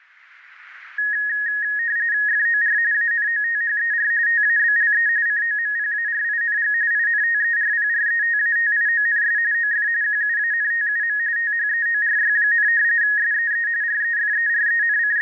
RTTY (45.45 baud, 170 Hz shift), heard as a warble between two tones, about 1750 Hz centre. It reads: FOR ANOTHER TABLE COMPARING INTERPRETATIONS OF QUANTUM THEORY, SEE …